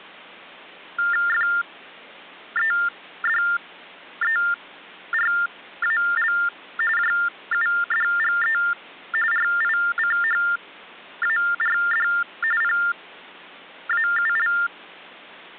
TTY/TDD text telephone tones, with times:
1.3-6.3 FEDERAL
7.0-8.6 JUDGE
9.3-12.1 RICHARD
12.6-14.5 PAUL

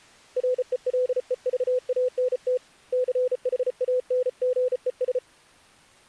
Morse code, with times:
0.4-2.6 RELEVANT
2.9-5.2 CHANGES

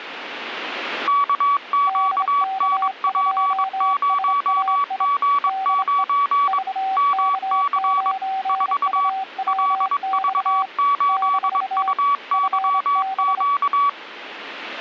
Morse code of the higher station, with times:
1.1-6.6 KQNP0G9
7.0-8.1 MC
8.5-9.1 4
9.5-13.9 LV8UYQ

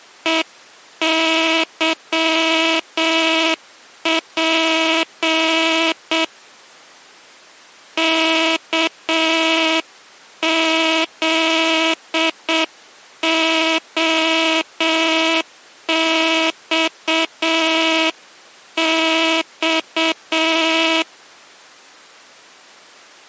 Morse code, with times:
0.3-6.2 EYP
8.0-21.0 KZOXX

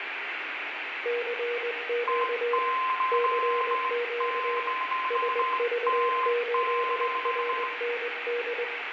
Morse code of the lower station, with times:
1.1-2.6 CQ
3.1-4.6 CQ
5.1-8.6 SV8RND

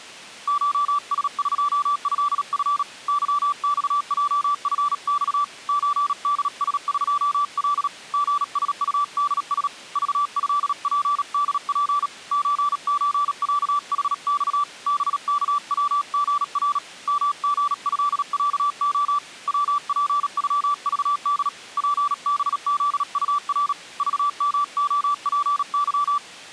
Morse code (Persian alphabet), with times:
0.5-2.8 شسقضف
3.1-5.4 ظخجفخ
5.7-7.9 چدسقل
8.1-9.7 ژسطدس
10.0-12.1 ذضپدپ
12.3-14.6 چچصحخ
14.9-16.8 بکوژر
17.1-19.2 مژضصع
19.5-21.5 وپغذد
21.8-23.7 پبزطر
24.0-26.2 ذمعپظ

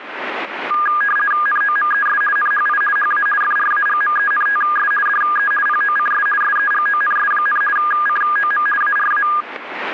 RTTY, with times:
1.5-2.2 NOMES
2.4-2.8 NHI
3.0-3.3 HA
3.4-4.9 FRAGMENTS
5.1-5.5 DE
5.7-6.3 POCS
6.4-7.6 SEGONS,
7.8-8.7 COM
8.8-9.3 ARA

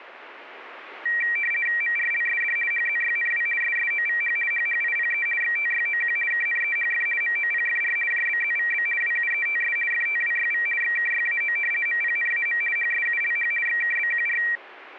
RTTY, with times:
1.8-2.6 MRLSD
2.7-3.5 HZYNW
3.6-4.4 SSOVH
4.5-5.3 HHIPE
5.4-6.2 XTYOQ
6.3-7.1 KNEHF
7.2-8.0 MOPFR
8.1-8.9 JBZVB
9.0-9.8 WUETS
9.9-10.7 FTWYV
10.8-11.6 XKYAO
11.9-12.6 MPNAM
12.8-13.5 HSULH
13.7-14.4 XKBQR

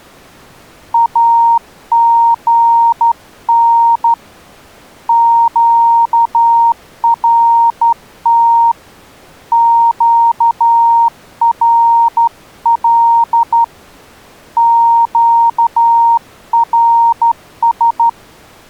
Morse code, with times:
0.9-4.1 AGN
5.1-8.7 QRT
9.5-13.6 QRL
14.6-18.1 QRS

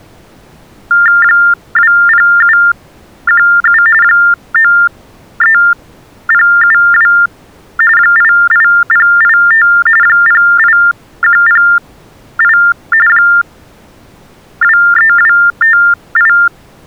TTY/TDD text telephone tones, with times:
1.2-3.8 20717
4.0-7.1 93072
8.0-9.7 88085
10.0-12.6 08108
13.1-16.3 23258

